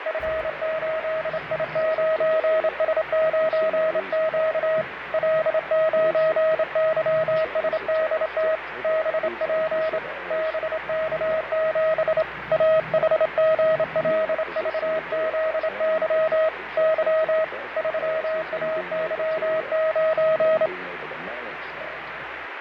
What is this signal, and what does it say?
Morse code, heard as a keyed tone, hand-sent with a straight key, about 27 wpm, 640 Hz, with radio static and fading. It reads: F8I9S9Q L9YSDT BP BK7 AHGLVZY Y 3AY9